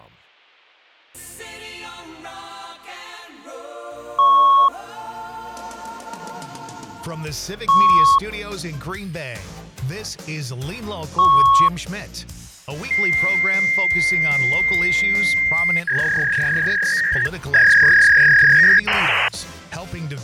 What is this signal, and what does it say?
Fax machine handshake, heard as beeps, a long tone, a warble and hiss.